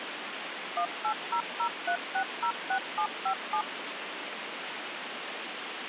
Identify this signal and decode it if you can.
DTMF, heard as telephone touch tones, dialled by machine, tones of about 80 ms, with phone line noise. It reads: 18003606757